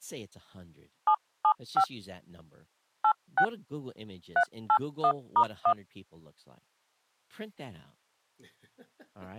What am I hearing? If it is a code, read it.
DTMF, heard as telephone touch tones, dialled by hand, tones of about 70 ms, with speech in English. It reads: 775 86 381*1